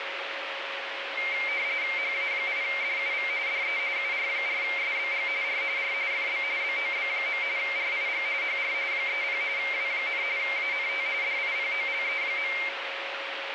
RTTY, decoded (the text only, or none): HA8DUV DE UR4SBG R R FB BOB. RIG HR 30 W, ANT DIPOLE.